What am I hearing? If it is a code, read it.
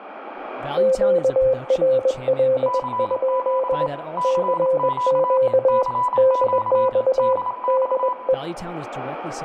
Morse code, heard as two keyed tones, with radio static, room echo and speech in English. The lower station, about 21 wpm, 520 Hz: QRL? CQ DX DE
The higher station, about 27 wpm, 990 Hz: CQ CQ CQ DX